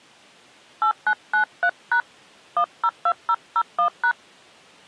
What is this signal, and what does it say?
DTMF, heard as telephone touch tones, dialled by hand, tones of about 80 ms. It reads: 8993# 102001#